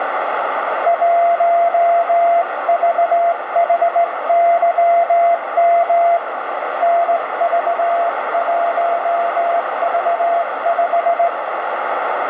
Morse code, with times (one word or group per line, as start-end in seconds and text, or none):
0.9-6.2 1VHYM
6.8-11.3 NV1V5